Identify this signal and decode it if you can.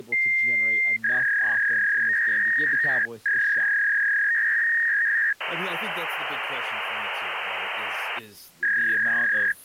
Fax machine handshake, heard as a long tone, a warble and hiss, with speech in English.